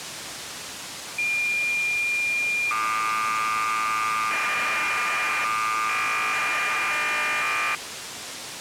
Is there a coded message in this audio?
Yes: cassette data (Kansas City type), 1200 baud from 1.2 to 7.8 s, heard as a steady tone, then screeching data, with tape hiss.